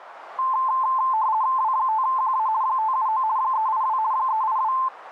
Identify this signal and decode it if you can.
RTTY (50 baud, 170 Hz shift), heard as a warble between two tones, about 960 Hz centre, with radio static. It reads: W5QA 579 382 382